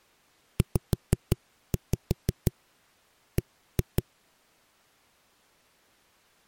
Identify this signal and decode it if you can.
Tap code, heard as knocks on a wall, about 6 knocks a second. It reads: ZB